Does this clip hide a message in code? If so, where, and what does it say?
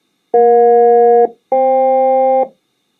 Yes: aircraft SELCAL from 0.3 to 2.4 s, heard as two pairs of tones. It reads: EJ-FK